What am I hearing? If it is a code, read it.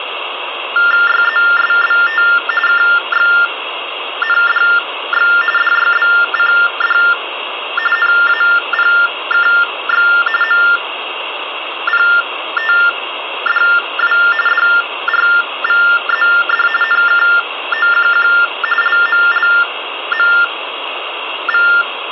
TTY/TDD text telephone tones (45.45 baud Baudot), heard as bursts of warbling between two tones, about 400 Hz shift, 1600 Hz centre, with phone line noise. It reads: YZSBT KXNDX DYBCD NAPKX MPTDW DRVZD NKOQQ LMLMV